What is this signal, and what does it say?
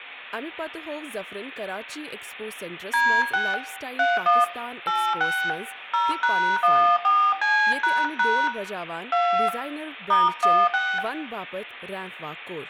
DTMF, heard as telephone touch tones, dialled by hand, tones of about 260 ms, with room echo and speech in Kashmiri. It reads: D6 31 86 0#14C## 2 *16